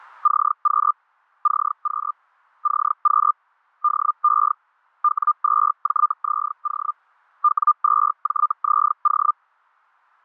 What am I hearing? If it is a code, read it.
Hellschreiber (Feld-Hell, 122.5 baud), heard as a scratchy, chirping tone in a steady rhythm, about 1200 Hz. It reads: CQ CQ CQ DE W2JZO W2JZO